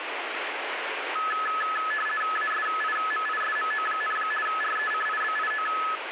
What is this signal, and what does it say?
RTTY (50 baud, 450 Hz shift), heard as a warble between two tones, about 1500 Hz centre, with radio static. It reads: ASIMISMO, RECIBIO